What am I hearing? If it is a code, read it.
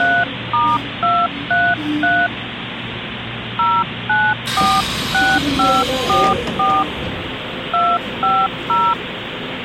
DTMF, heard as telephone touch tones, dialled by hand, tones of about 240 ms, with phone line noise and the noise inside a subway train. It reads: 3*233 0946544 250